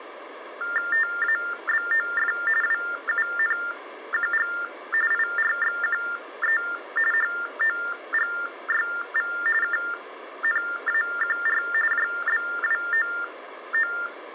TTY/TDD text telephone tones (45.45 baud Baudot), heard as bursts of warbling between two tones, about 400 Hz shift, 1600 Hz centre. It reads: TABOF WUNQG IRXQE HOGYV KNAQR JBWOO